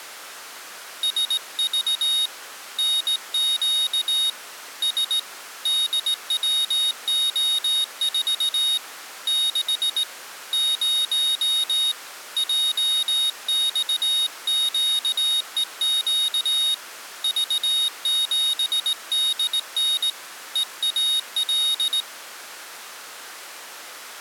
Morse code, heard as a high beeper, hand-sent with a straight key, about 18 wpm, 3750 Hz. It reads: SV NQ S DWO4 6 0 JXQEQ V7DN EAL